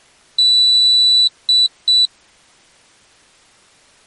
Beep code, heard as a piezo beeper, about 3950 Hz. 1 long, 2 short. In Award, IBM and AMI BIOS tables: video adapter failure.